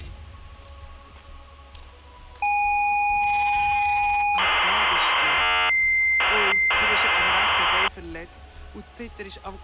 ZX Spectrum tape loading, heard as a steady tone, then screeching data.